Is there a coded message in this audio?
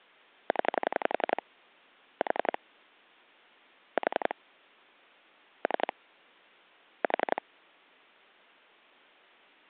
Yes: pulse dialling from 0.5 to 7.4 s, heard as clicks on a phone line, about 11 pulses a second. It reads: 0 4 4 3 4